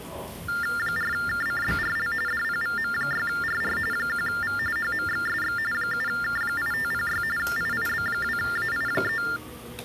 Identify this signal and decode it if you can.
TTY/TDD text telephone tones (45.45 baud Baudot), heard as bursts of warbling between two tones, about 400 Hz shift, 1600 Hz centre, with hum and the noise of a restaurant. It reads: 4KCBRL DPVM6RR 1V HMXSX 7K8506 IIB2AI3